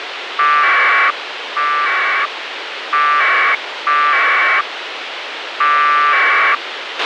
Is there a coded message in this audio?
Yes: packet radio (AX.25, as in APRS), 1200 baud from 0.4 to 6.6 s, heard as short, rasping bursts, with radio hiss and a squelch burst at the end.